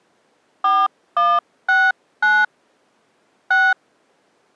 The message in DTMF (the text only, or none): 4169 6